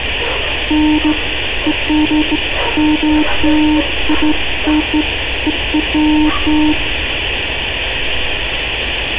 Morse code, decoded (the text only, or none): none